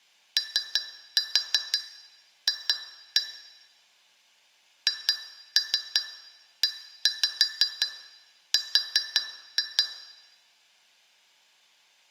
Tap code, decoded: OF HER

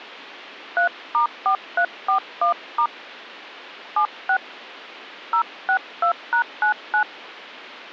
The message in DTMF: 3*4341* 76 062#99

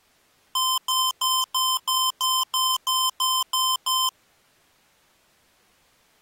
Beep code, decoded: 11 short

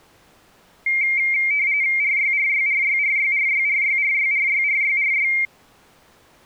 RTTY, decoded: RYRYRYRYRYRYRYRYRYRY

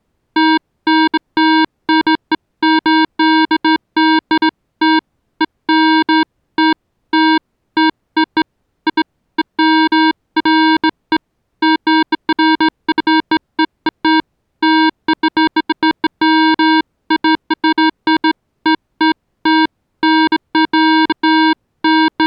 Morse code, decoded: none

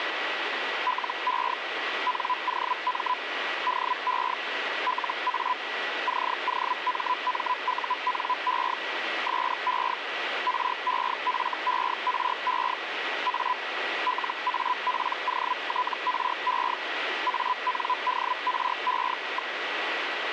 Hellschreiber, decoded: LE NOM DE LA COMMUNE SE REFERE A LAPOTRE ANDRE.

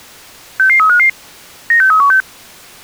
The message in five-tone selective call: 66355 96316

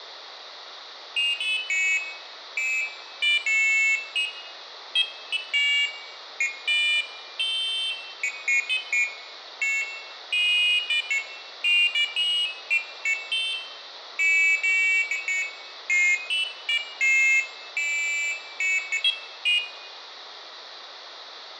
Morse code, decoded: none

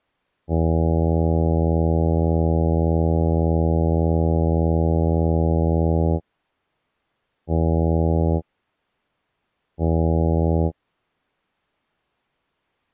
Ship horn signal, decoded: 1 long, 2 short

